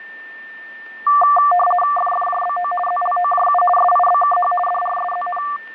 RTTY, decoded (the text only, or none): FFJBO ZLOJU SIBKH DRSZN